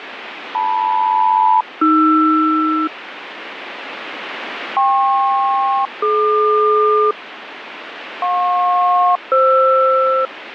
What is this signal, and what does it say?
Aircraft SELCAL, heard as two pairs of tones, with radio static. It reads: LM-AR KP-DQ JP-FR